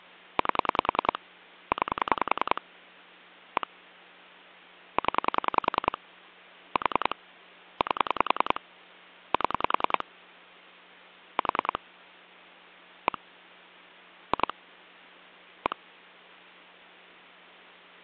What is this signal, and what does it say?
Pulse dialling, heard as clicks on a phone line, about 10 pulses a second, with hum. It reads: 8 9 1 0 4 8 7 4 1 2 1